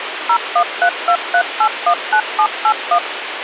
DTMF, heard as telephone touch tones, dialled by machine, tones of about 80 ms, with phone line noise. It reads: 01323819781